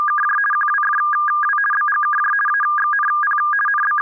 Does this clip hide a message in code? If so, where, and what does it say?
Yes: RTTY (50 baud, 450 Hz shift) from 0.0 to 4.0 s, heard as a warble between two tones, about 1420 Hz centre. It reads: … QWFW BGKJ AXNP …